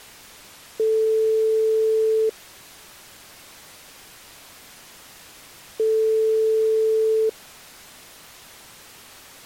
Telephone call progress tone (single-tone plan, as in most of Europe), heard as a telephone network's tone, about 440 Hz, 1.5 s on and 3.5 s off. Ringback tone.